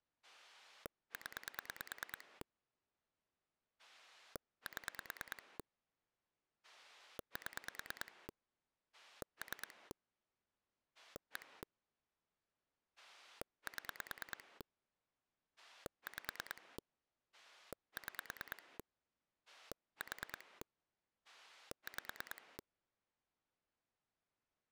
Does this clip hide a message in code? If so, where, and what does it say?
Yes: pulse dialling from 0.2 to 22.6 s, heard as a rotary dial, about 9 pulses a second. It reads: 0 7 7 3 1 7 5 6 4 5